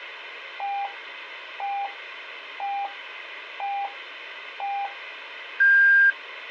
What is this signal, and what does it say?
Radio time signal (five pips and a higher one, as on Chinese radio), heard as pips.